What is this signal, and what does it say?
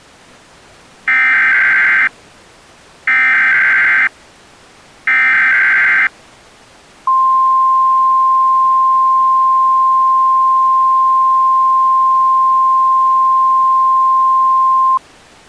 Emergency Alert System (SAME) tones (header bursts, then the 1050 Hz attention tone), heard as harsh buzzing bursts, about 520.83 baud.